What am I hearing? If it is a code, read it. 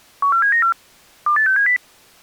Five-tone selective call (CCIR), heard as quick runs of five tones, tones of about 100 ms. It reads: 14794 28670